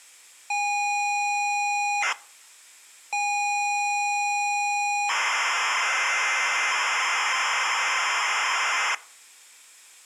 ZX Spectrum tape loading, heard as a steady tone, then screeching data.